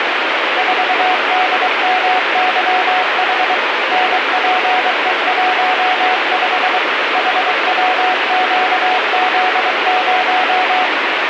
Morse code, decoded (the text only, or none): 4DMYH NPE15 HWQZ0